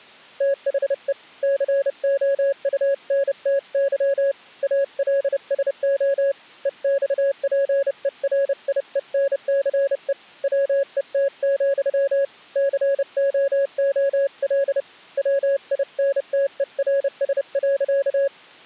Morse code, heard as a keyed tone, hand-sent with a paddle, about 30 wpm, 550 Hz. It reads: THE COUNTY ALSO EXPERIENCE WET, COOL WINTERS.